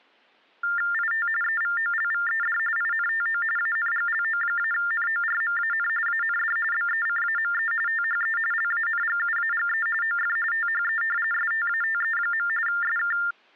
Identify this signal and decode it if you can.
TTY/TDD text telephone tones (45.45 baud Baudot), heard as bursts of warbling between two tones, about 400 Hz shift, 1600 Hz centre. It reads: IT EVOLVED INTO ANGLO-NORMAN AND BECAME THE LANGUAGE OF THE STATE. SK